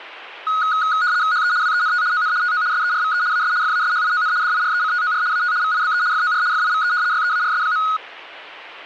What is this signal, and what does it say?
RTTY (75 baud, 170 Hz shift), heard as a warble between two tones, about 1360 Hz centre. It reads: HE WENT ON TO SERVE AS FASHION DIRECTOR AT VIBE FOR FIVE YEARS.